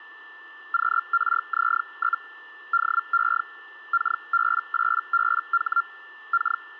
Hellschreiber (Feld-Hell, 122.5 baud), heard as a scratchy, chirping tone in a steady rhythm, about 1380 Hz, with a steady whistle near 1770 Hz. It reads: QRZ? DE KB8BH K